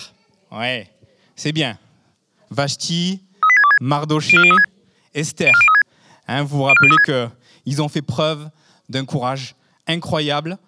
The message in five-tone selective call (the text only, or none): 38626 04036 04036 04036